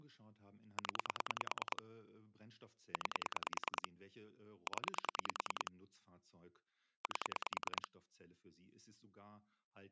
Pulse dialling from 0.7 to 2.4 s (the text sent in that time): 0